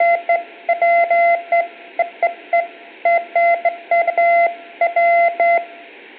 Beeps of irregular length, with room echo. There is no code.